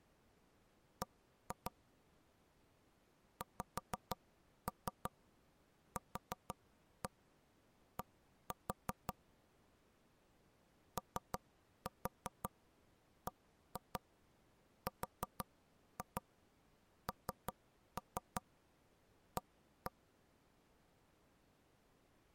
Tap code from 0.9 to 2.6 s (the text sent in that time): B